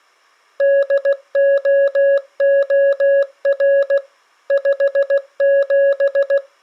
Morse code, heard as a keyed tone, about 16 wpm, 560 Hz. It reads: DOOR 57